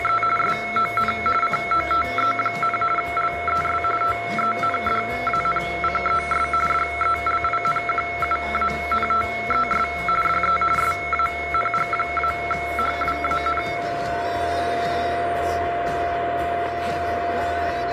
RTTY (45.45 baud, 850 Hz shift), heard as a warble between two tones, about 1750 Hz centre, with radio static and a steady whistle near 690 Hz. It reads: … SON COTE, LES TENDANCES DELINQUANTES DE SANG-HWAN